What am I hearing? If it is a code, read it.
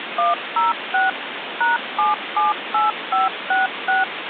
DTMF, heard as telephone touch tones, dialled by machine, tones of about 160 ms, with phone line noise. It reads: 106 #778566